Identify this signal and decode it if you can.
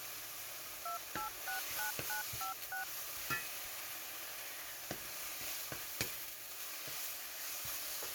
DTMF, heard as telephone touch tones, dialled by machine, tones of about 120 ms, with kitchen noise. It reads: 2869956